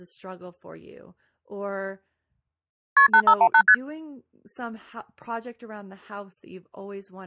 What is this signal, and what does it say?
Multi-frequency trunk signalling (R1, as on North American trunks), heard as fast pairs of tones, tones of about 70 ms, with speech in English. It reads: KP 8518 ST